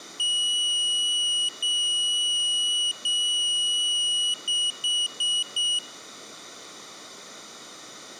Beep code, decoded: 3 long, 4 short

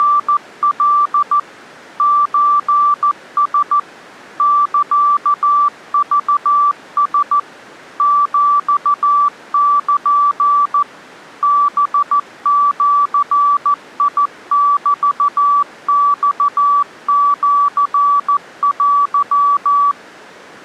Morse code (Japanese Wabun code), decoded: … ソラ サクラ ヒル ハジメマシテ

